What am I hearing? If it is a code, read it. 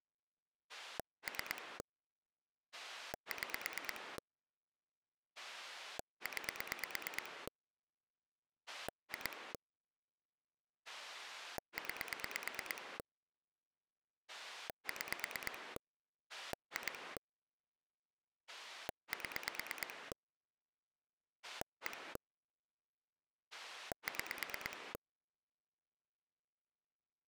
Pulse dialling, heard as a rotary dial, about 9 pulses a second. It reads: 3 6 9 2 9 6 2 7 1 6